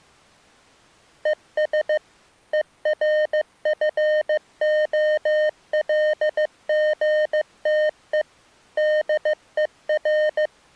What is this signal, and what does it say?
Morse code, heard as electronic beeps, machine-sent, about 15 wpm, 610 Hz. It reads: ES ERFOLGTE DER